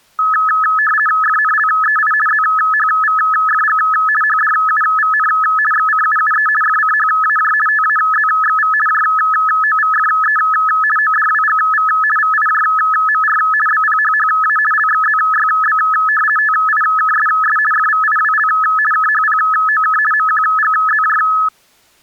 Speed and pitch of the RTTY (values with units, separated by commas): 50 baud, 450 Hz shift, 1500 Hz centre